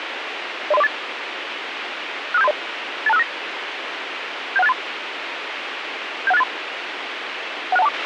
Five-tone selective call (EIA), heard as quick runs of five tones, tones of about 30 ms, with radio hiss and a squelch burst at the end. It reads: 03048 65730 82659 71683 71683 16124